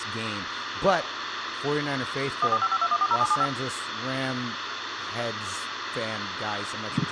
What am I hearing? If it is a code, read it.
DTMF, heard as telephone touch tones, dialled by machine, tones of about 50 ms, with phone line noise, room echo and speech in English. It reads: 14552140775